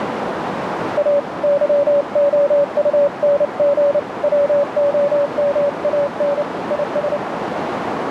Morse code, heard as a keyed tone, hand-sent with a paddle, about 29 wpm, 570 Hz, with heavy radio static and a narrow filter. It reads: A YOUNG WOMAN IS